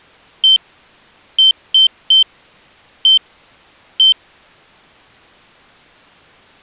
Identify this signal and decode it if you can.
Beep code, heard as a piezo beeper, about 3100 Hz. 1-3-1-1. In Phoenix BIOS tables: memory refresh test failure.